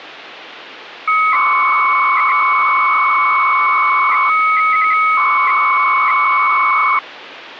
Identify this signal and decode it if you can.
300-baud modem data (Bell 103 tones), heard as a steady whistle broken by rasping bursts, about 300 baud, 200 Hz shift, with phone line noise.